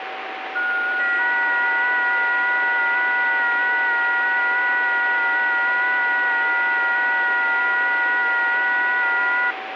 FT8 (several signals at once), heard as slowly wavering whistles, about 6.25 baud, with radio static and a steady whistle near 760 Hz.